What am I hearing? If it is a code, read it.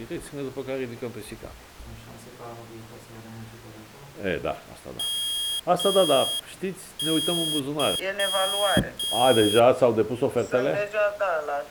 Morse code (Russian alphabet), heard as a high beeper, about 6 wpm, 3250 Hz. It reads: МЫ